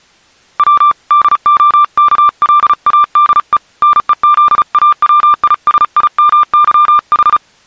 Morse code (Russian alphabet), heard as a keyed tone, hand-sent with a paddle, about 35 wpm, 1190 Hz. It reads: В ДОКЛАДЕ НЕЗАВИСИМЫХ